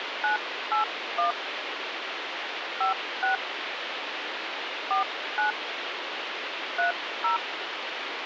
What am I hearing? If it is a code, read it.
DTMF, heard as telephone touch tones, dialled by hand, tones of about 120 ms, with phone line noise. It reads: 981 56 49 30